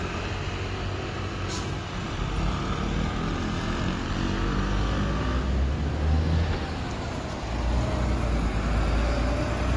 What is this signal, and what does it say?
Street noise. There is no code.